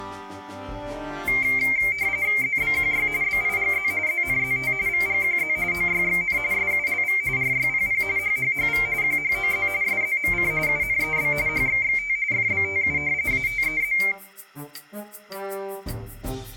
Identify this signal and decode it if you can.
RTTY (45.45 baud, 170 Hz shift), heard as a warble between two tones, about 2200 Hz centre, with room echo. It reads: ZBQY BIGZ ZNZT VGQZ OYXN SULV RYPP HHHV QHOZ SZMC UNEB HXXT FBTU ATEZ